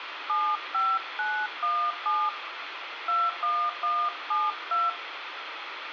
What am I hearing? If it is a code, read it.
DTMF, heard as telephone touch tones, dialled by hand, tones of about 250 ms, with radio hiss and room echo. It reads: 75917 21172